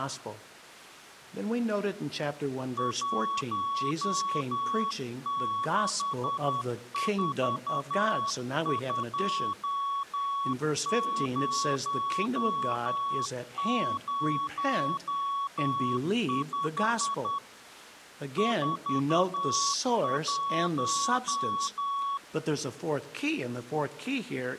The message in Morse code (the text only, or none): 1642005 41